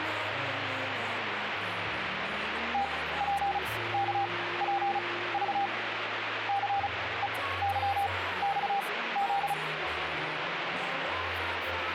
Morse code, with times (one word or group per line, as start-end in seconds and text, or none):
2.7-5.7 TPKPV
6.5-9.5 CEYXZ